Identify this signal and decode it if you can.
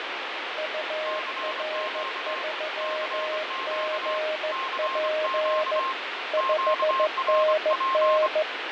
Morse code, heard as two keyed tones, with heavy radio static and fading. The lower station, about 15 wpm, 620 Hz: UR3GP 5NN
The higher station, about 25 wpm, 1060 Hz: CQ CQ CQ QRP